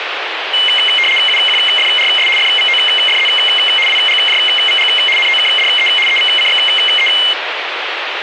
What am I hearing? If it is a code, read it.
RTTY (75 baud, 850 Hz shift), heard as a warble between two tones, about 2550 Hz centre, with radio static. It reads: UQFRS FVOFZ WGJVG NOKDE EVCXE